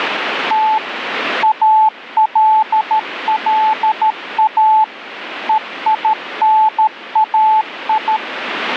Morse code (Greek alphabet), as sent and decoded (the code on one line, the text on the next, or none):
- / .- .-.. .-.. .- / . .. -. .- ..
Τ ΑΛΛΑ ΕΙΝΑΙ